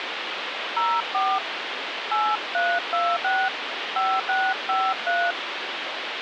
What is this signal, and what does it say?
DTMF, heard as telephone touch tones, dialled by hand, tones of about 240 ms, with phone line noise. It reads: 04 8326 5653